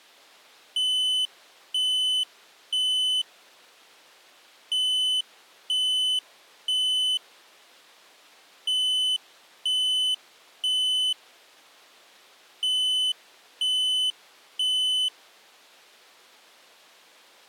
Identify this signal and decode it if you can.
Alarm pattern, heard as an alarm's beeps, played four times, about 3000 Hz. Temporal three. Smoke or fire, evacuate.